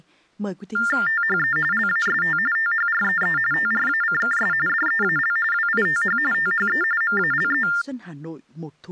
TTY/TDD text telephone tones (45.45 baud Baudot), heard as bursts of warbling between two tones, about 400 Hz shift, 1600 Hz centre, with speech in Vietnamese. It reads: THE LAST THREE TRACKS DEAL WITH THE MALE